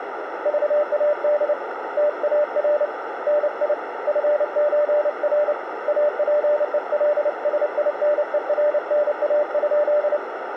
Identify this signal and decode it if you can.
Morse code (with Swedish letters), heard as a keyed tone, hand-sent with a paddle, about 29 wpm, 590 Hz, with radio static and a narrow filter. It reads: VAD TAR NI FÖR APELSINERNA?